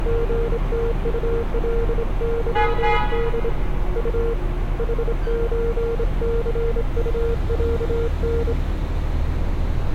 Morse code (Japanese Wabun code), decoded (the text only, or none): リムウカケホ ウ ヌソニウロタ